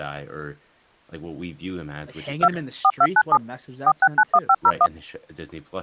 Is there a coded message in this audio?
Yes: DTMF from 2.4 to 4.9 s, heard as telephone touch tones, dialled by machine, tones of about 60 ms, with speech in English. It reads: 2 4297 4691501